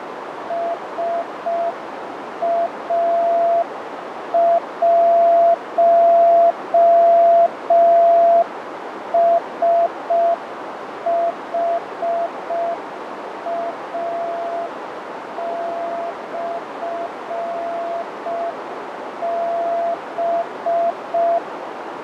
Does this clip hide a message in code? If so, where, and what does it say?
Yes: Morse code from 0.4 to 21.4 s, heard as a keyed tone, machine-sent, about 5 wpm, 680 Hz, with heavy radio static, fading and a narrow filter. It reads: SA1SHA/B